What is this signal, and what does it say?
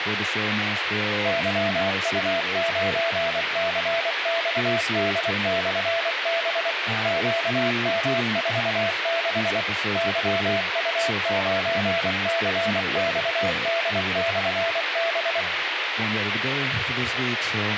Morse code, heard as a keyed tone, machine-sent, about 24 wpm, 670 Hz, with radio hiss and speech in English. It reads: YU9CXD/B QM46 YU9CXD/B